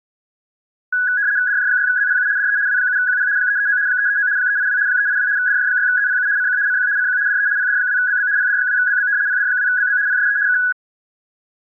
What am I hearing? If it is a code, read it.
RTTY (75 baud, 170 Hz shift), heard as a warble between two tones, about 1550 Hz centre. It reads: DJ6ZPU DE W7QP 339 339 382 382 DJ6ZPU CQ CQ CQ DE PD2BB PD2BB PD2BB PSE K